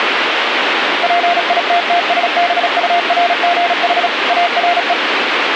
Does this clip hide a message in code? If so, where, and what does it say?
Yes: Morse code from 1.0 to 5.0 s, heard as a keyed tone, machine-sent, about 36 wpm, 700 Hz, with radio static. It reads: PITTSBURGH ARE